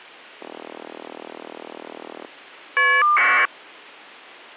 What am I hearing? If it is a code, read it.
Caller ID data burst, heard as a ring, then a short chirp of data, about 1200 baud.